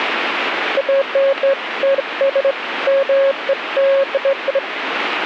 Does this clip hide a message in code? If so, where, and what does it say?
No, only beeps of irregular length, with radio static.